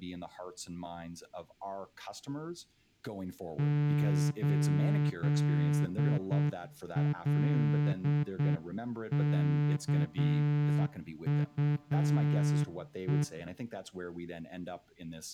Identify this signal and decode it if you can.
Morse code, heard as a horn, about 8 wpm, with speech in English. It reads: 8LKUE